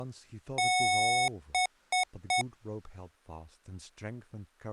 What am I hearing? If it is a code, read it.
Beep code, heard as beeps from a small speaker, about 740 Hz, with speech in English. 1 long, 3 short. In Award and IBM BIOS tables: video adapter failure; in AMI BIOS tables: memory failure.